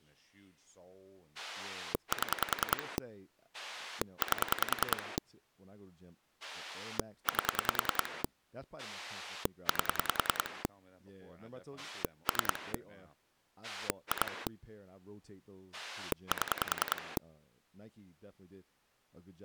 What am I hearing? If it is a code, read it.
Pulse dialling, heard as a rotary dial, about 10 pulses a second, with speech in English. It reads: 7 8 8 8 3 2 7